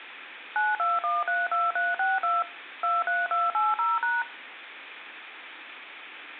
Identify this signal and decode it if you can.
DTMF, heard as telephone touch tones, dialled by machine, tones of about 190 ms. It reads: 92132362 23280#